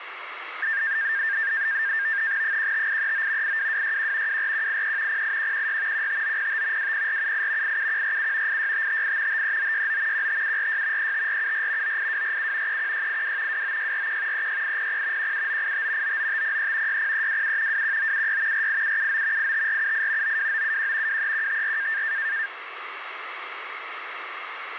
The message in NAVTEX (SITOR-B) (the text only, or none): 15839 82261 24183 08116 15905 20478 87147 86558 53969 15746 35474 98247 31682 29641 36800 17985 99503 60327 21976 48779 85478 92971 23154